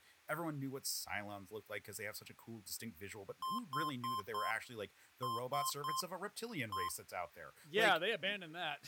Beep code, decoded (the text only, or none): 4-3-1